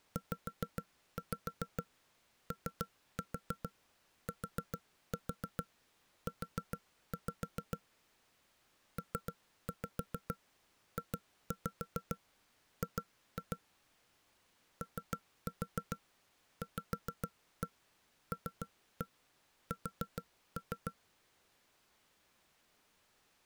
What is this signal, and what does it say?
Tap code, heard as knocks on wood, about 7 knocks a second. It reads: ZOTU PJG OVLS